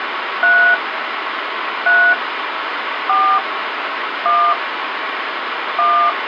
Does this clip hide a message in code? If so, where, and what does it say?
Yes: DTMF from 0.4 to 6.1 s, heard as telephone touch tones, dialled by hand, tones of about 270 ms, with phone line noise. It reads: 3 3 4 1 1